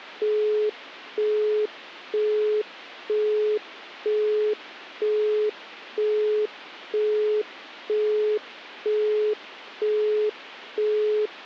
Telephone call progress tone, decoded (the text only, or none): busy tone